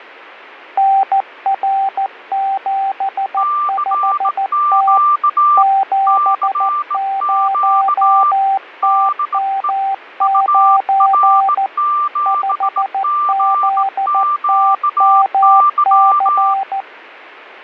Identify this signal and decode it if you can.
Morse code, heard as two keyed tones. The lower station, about 14 wpm, 780 Hz: NR75T 70TM9 5ZTMC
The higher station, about 18 wpm, 1180 Hz: CQ CQ DE UR7GQY